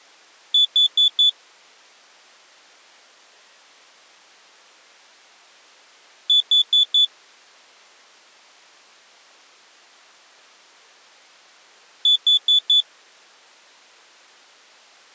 Alarm pattern, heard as an alarm's beeps, played three times, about 3450 Hz. Temporal four. Carbon monoxide.